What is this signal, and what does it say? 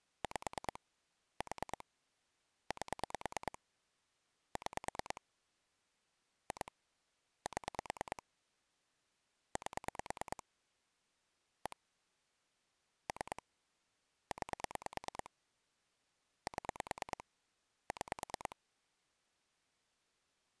Pulse dialling, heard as clicks on a phone line, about 9 pulses a second. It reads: 5 4 8 6 2 7 8 1 3 9 7 6